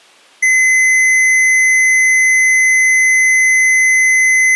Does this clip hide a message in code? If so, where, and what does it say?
No, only a steady tone.